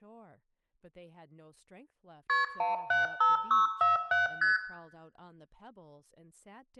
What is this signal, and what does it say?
Multi-frequency trunk signalling (R1, as on North American trunks), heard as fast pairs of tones, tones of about 150 ms, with room echo and speech in English. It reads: KP 175647 ST